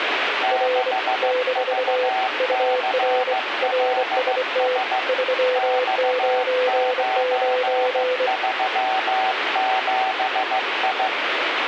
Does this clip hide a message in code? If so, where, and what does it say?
Yes: Morse code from 0.4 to 11.1 s, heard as two keyed tones, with radio static. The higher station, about 15 wpm, 760 Hz: 6VCLS X937I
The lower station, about 24 wpm, 500 Hz: R - UR RST 399